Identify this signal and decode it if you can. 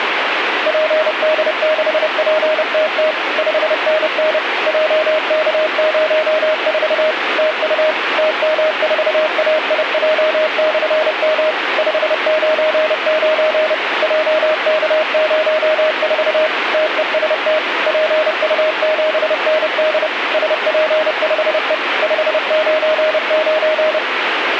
Morse code, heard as a keyed tone, machine-sent, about 30 wpm, 620 Hz, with radio static. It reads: PD6PTT 5NN JK04 TU TM4AIJ/M 599 JK04 TEST PU7ND SP5E 599